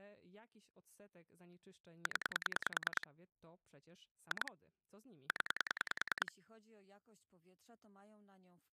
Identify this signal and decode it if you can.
Pulse dialling, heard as clicks on a phone line, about 10 pulses a second, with speech in Polish. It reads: 0 2 0